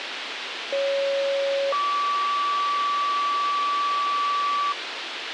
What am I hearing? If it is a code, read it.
Two-tone page, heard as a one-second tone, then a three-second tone, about 550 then 1150 Hz, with radio hiss.